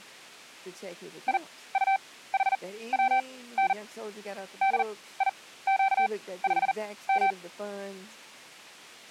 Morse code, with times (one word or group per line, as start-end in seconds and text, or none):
1.3-3.7 IUHWN
4.6-7.3 DIQ5M